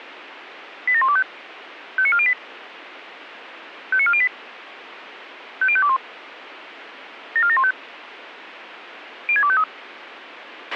Five-tone selective call (ZVEI), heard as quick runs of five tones, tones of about 70 ms, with radio hiss and a squelch burst at the end. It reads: 87125 59408 59408 50521 74715 06253